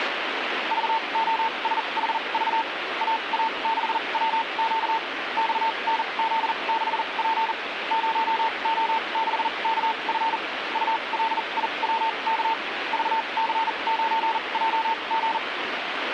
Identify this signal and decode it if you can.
Morse code, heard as a keyed tone, machine-sent, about 40 wpm, spaced as for 30 wpm, 900 Hz, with radio static. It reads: VOSHV AA6WQ XNZ6P 0O6KF ULIWK VC9JG